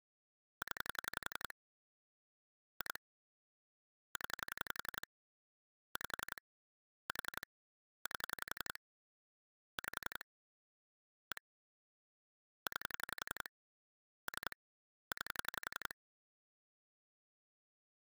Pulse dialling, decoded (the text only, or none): 0 2 0 5 4 8 5 1 9 3 9